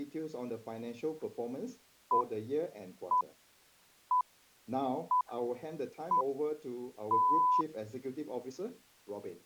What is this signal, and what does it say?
Radio time signal (six pips, as the Greenwich Time Signal), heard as pips.